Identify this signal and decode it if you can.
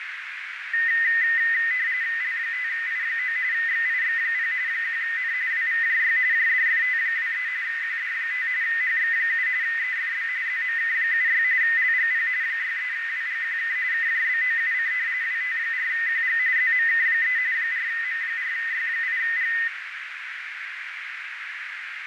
RTTY (45.45 baud, 170 Hz shift), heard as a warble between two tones, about 1900 Hz centre, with radio static and a narrow filter. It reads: L5I9 XIX0 1N WVJY JDFT23 QD5 HX7 EFB ZMK76 LGP 63WGQK KJBOUC WT4QG ZMK3 4M4Y8G